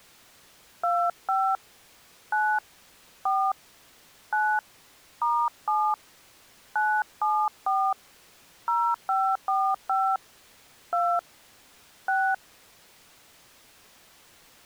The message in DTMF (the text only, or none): 25 9 4 9 *7 974 0545 2 6